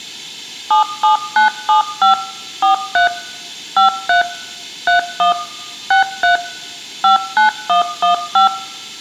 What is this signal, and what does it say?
DTMF, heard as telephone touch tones, dialled by machine, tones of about 120 ms, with room echo. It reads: 77975 43 53 31 63 59115